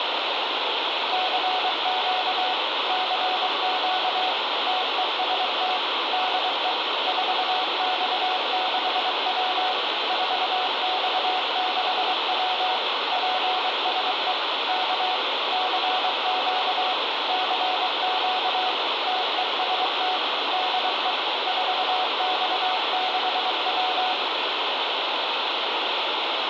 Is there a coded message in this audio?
Yes: Morse code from 1.1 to 24.2 s, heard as two keyed tones, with heavy radio static. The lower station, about 23 wpm, 740 Hz: CQ CQ TEST DE 4X6W 4X6W PSE K CQ CQ TEST DE 4X6W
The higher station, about 33 wpm, 1140 Hz: BK GM DR OM TNX FER CALL UR RST IS 499 NAME IS WANG QTH IS